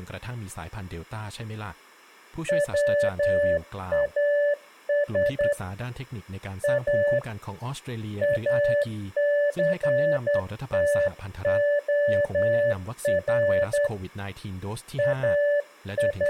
Morse code, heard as a keyed tone, hand-sent with a straight key, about 10 wpm, 580 Hz, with speech in Thai. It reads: WAS A ACTOR …